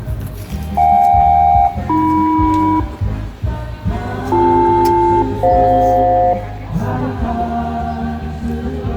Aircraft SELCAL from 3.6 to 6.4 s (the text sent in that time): BL-FJ